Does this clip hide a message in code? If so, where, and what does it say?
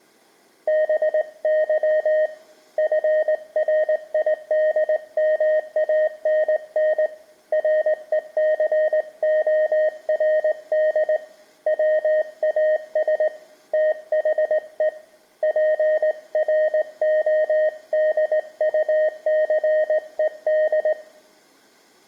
Yes: Morse code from 0.6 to 21.0 s, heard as a keyed tone, hand-sent with a straight key, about 19 wpm, 620 Hz, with room echo. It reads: BY FRIDMANN RECORD WAS THE PRODUCED